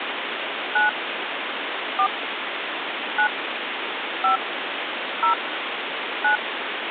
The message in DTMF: 9 4 9 5 0 9

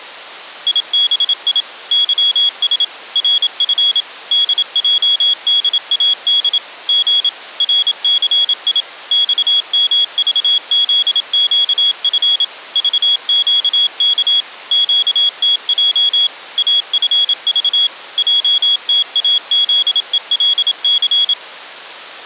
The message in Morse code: IBI YS RF DJDAD G RCI XMVZQF VQK QTJ AFV JTAZELC

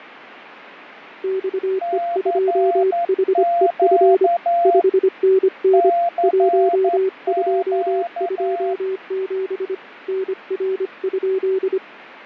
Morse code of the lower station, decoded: XE2HEF 5NN 1227 NR?

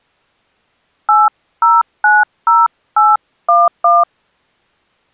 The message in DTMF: 8090811

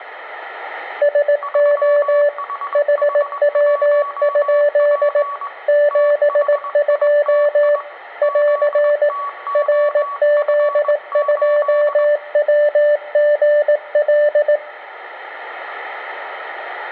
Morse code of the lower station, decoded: SO HW? 72 <AR> RZ2WGL

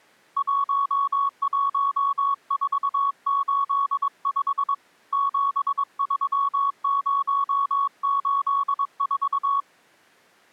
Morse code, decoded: 11485 73084

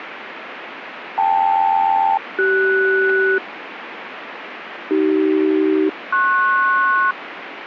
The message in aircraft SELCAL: KL-CS AC-PS

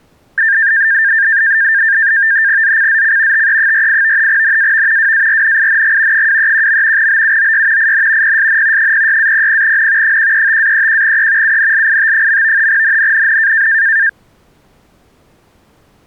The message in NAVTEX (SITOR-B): ZCZC TE48 NAV WARNING 231. BUOY IN PSN 06-00N 135-31E UNLIT. NNNN

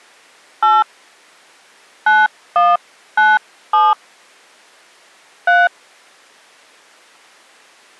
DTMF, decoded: 8 9197 3

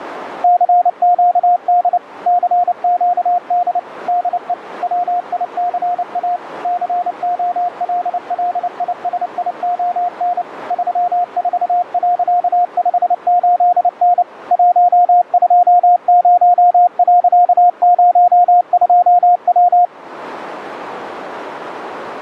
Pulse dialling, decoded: none

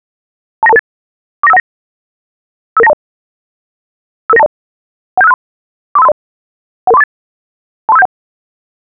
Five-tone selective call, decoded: 29228 49519 55920 55920 17563 43530 11348 23571

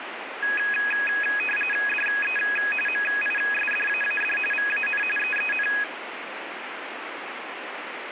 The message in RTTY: DE MISDAAD VAN EEN

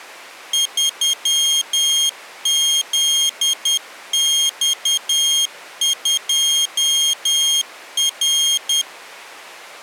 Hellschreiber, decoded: none

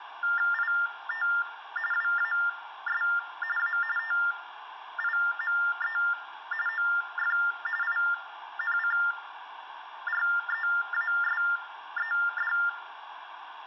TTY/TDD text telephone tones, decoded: IT WAS A TIME OF INCREASED

